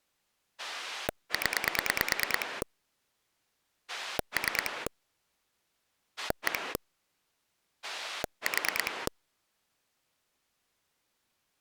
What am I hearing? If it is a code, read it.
Pulse dialling, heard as a rotary dial, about 9 pulses a second. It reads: 0 3 1 4